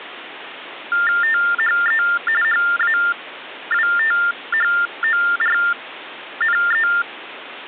TTY/TDD text telephone tones (45.45 baud Baudot), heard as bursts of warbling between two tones, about 400 Hz shift, 1600 Hz centre, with phone line noise. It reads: THE HAWTHORNE